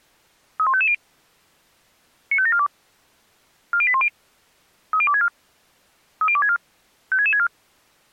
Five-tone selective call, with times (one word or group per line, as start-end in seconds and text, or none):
0.6-0.9 31550
2.3-2.7 95742
3.7-4.1 40810
4.9-5.3 30264
6.2-6.6 30264
7.1-7.5 56664